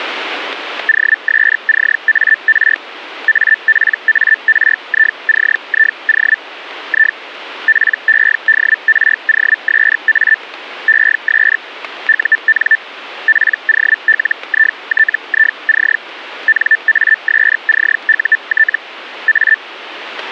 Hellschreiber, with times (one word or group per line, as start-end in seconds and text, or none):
0.9-2.8 OSCAR
3.3-6.4 APARICIO
6.9-7.2 I
7.7-10.4 PEDROSA
10.9-11.6 ES
12.1-12.8 UN
13.3-16.0 POLITIC
16.5-18.8 NASCUT
19.3-19.6 A